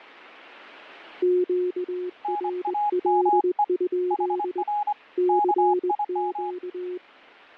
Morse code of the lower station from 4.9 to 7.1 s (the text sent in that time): CQ